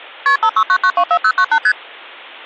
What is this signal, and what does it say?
Multi-frequency trunk signalling (R1, as on North American trunks), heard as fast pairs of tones, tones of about 70 ms. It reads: KP 569924098 ST